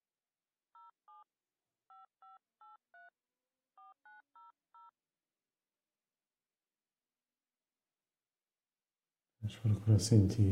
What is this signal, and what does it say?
DTMF, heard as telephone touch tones, dialled by hand, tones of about 150 ms. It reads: 07 5583 4900